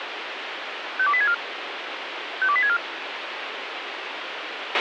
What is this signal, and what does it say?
Five-tone selective call (ZVEI), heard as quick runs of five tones, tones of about 70 ms, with radio hiss and a squelch burst at the end. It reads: 52864 52864